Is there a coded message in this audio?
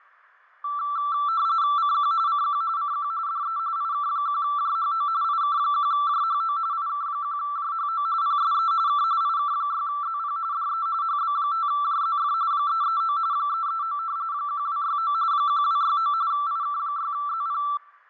Yes: RTTY (45.45 baud, 170 Hz shift) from 0.6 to 17.8 s, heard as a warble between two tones, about 1250 Hz centre, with fading. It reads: CQ CQ CQ DE IK1JHO IK1JHO IK1JHO PSE K IK6ZP DE HB5JZF 339 339 1269 1269 IK6ZP